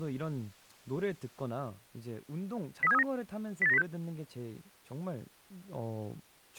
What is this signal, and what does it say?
Five-tone selective call (EEA), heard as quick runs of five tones, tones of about 40 ms, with speech in Korean. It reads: 03739 08906